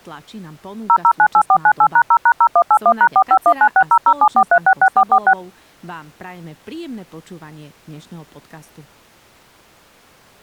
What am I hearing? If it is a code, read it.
DTMF, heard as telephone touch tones, dialled by machine, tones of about 70 ms, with speech in Slovak. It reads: 0098498#0#0181#451960074366446